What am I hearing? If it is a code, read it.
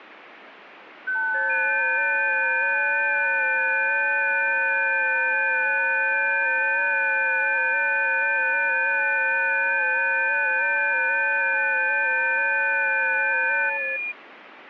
FT8 (several signals at once), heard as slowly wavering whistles, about 6.25 baud, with radio static.